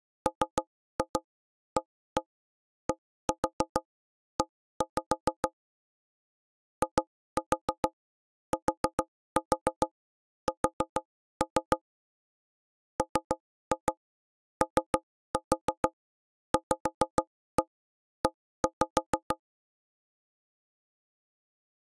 Tap code, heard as knocks on wood, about 6 knocks a second. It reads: MADE ITS MOVE